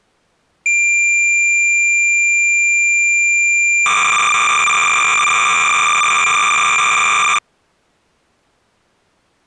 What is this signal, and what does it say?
Cassette data (Kansas City type), 300 baud, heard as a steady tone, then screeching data.